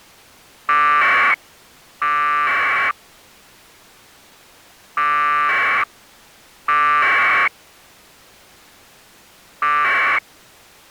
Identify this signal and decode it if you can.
Packet radio (AX.25, as in APRS), 1200 baud, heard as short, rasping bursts.